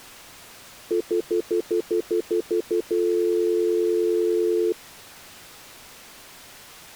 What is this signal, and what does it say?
Telephone call progress tone (North American plan), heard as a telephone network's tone, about 350, 440 Hz, 0.1 s on and 0.1 s off. Stutter dial tone.